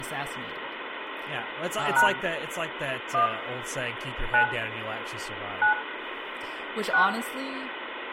DTMF, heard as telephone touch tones, dialled by hand, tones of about 110 ms, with phone line noise, room echo and speech in English. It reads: # 1 9 9 6